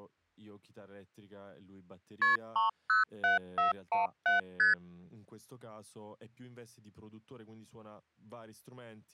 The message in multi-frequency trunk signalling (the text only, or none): KP 307417 ST